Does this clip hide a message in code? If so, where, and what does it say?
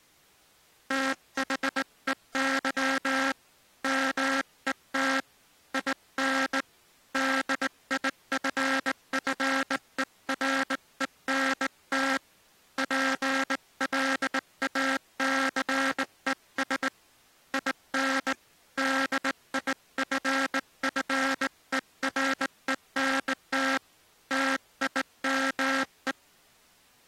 Yes: Morse code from 0.8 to 26.2 s, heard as a buzzer, hand-sent with a straight key, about 19 wpm. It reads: THEY MET IN DIFFERENT PLACES IN DIFFERENT TIME